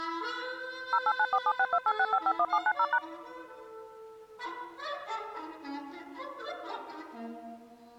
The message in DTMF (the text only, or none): 089476286551790#